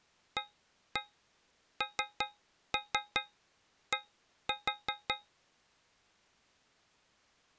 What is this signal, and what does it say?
Tap code, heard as taps on a metal pipe, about 5 knocks a second. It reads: AND